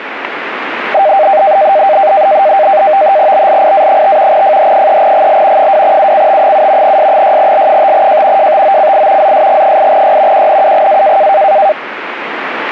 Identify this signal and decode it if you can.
NAVTEX (SITOR-B), 100 baud, 170 Hz shift, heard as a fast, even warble, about 700 Hz centre, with radio static. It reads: BLIA5 FH3GL 2UCT7 S6L5J JTOCI ZSG8Y QNUGA